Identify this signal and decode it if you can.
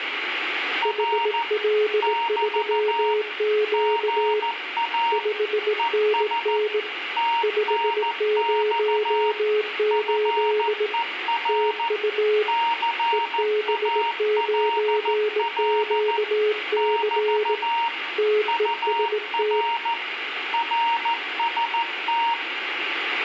Morse code, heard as two keyed tones, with radio static and room echo. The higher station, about 14 wpm, 930 Hz: R <BT> GA ES TNX FER CALL <BT> UR RST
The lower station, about 18 wpm, 420 Hz: HL3Q 5NN 508 TU EB9QC TEST